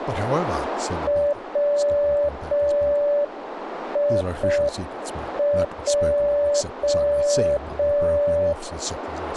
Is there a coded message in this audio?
Yes: Morse code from 1.0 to 8.6 s, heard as a keyed tone, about 5 wpm, 580 Hz, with radio static, a narrow filter and speech in English. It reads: WIJ